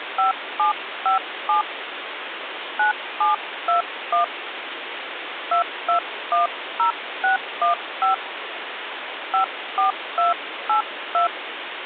DTMF, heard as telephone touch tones, dialled by hand, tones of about 130 ms, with phone line noise. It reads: 5757 9721 2210615 54282